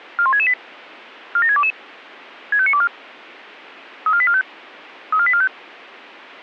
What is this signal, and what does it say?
Five-tone selective call (ZVEI), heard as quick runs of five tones, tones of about 70 ms. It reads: 41668 47622 65924 34845 34845